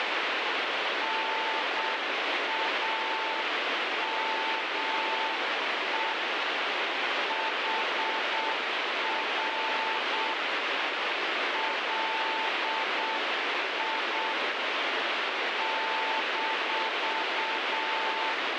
Morse code, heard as a keyed tone, hand-sent with a paddle, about 7 wpm, 890 Hz, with heavy radio static. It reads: NAME HR LI -